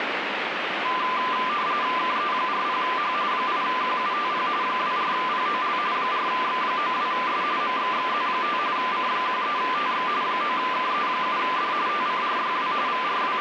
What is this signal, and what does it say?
RTTY (45.45 baud, 170 Hz shift), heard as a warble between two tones, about 1100 Hz centre, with radio static. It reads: KE40H 8QUTP 24POL 4X92S MXXZ5 C13TX 9KE7D TCRYW …